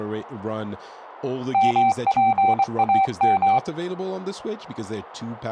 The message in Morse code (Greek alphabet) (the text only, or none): ΜΠΑΜ